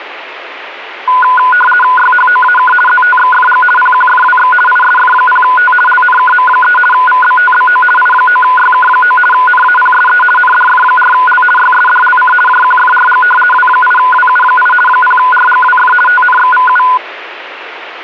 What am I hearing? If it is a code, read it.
RTTY (50 baud, 450 Hz shift), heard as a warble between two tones, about 1230 Hz centre, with radio static. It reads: YHOAK ZTXFG PQFWX ISF0T LNKM3 VBTBO I9YK9 NAPSE NDF4L YSDLC JQFRG W8WU8 0RGWF TNXVU